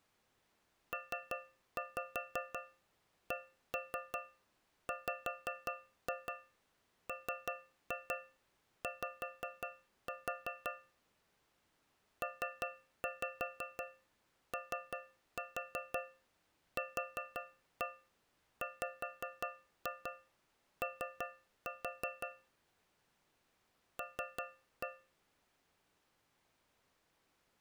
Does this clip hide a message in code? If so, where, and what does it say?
Yes: tap code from 0.9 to 25.2 s, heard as taps on a metal pipe, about 5 knocks a second. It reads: PCWMY POQWO L